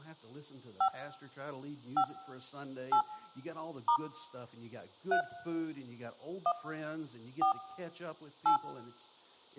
DTMF, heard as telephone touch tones, dialled by hand, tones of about 80 ms. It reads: 5 5 8 * 3 1 4 8